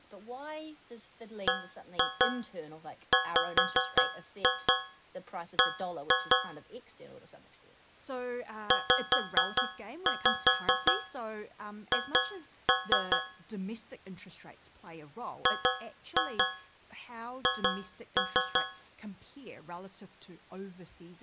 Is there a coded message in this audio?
Yes: tap code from 1.5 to 19.0 s, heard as taps on a metal pipe, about 5 knocks a second, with speech in English. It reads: BWB ZH GH